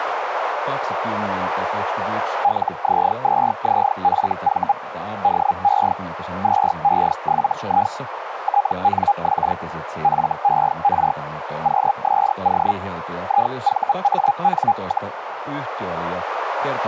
Hellschreiber (Feld-Hell, 122.5 baud), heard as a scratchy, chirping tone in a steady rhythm, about 810 Hz, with radio static, a narrow filter and speech in Finnish. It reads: LZ2ZFV DE 2E7I TNX FER QSO IVAN,